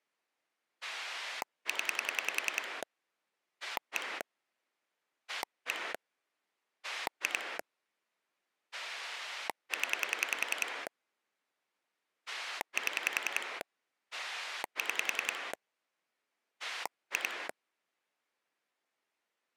Pulse dialling, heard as a rotary dial, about 10 pulses a second. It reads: 0 1 1 2 0 7 6 2